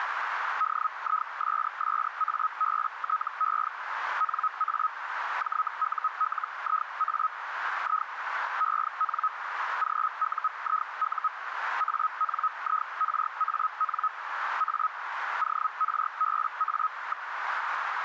Hellschreiber (Feld-Hell, 122.5 baud), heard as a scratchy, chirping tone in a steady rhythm, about 1270 Hz, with radio static and a narrow filter. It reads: DISSABTE NA JULIA I EN GUIU ANIRAN A ORBA.